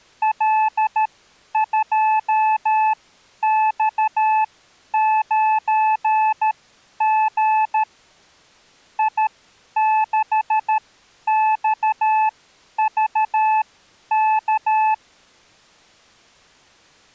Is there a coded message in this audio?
Yes: Morse code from 0.2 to 15.0 s, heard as a keyed tone, machine-sent, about 13 wpm, spaced as for 10 wpm, 870 Hz. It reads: L2X9G I6XVK